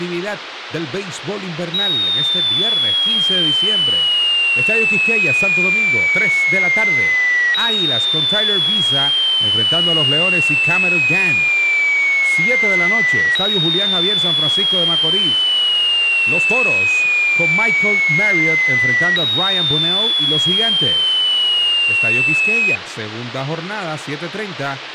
A tone that sweeps in pitch again and again, with radio hiss and speech in Spanish. There is no code.